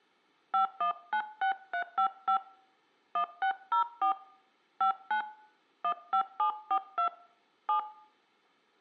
DTMF, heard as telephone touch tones, dialled by hand, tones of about 90 ms. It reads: 5196355 1604 59 15742 7